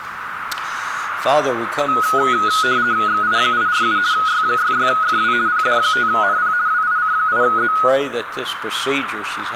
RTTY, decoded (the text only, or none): XI847 Y66FW PD5NP WIC8Z